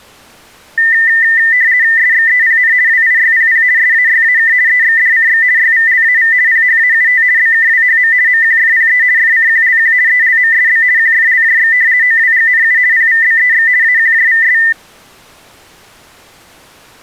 RTTY (50 baud, 170 Hz shift), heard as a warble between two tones, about 1900 Hz centre. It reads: SXEPN WIYPP SAYAK EXDCX YVLAV PHAUT BKWHM MQFPE FCQLQ ELMSB QFLJX OWGNU PVBEX AQJVS